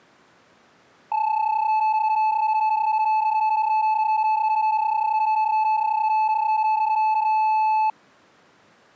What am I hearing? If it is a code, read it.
PSK31 (31.25 baud), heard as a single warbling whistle, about 870 Hz.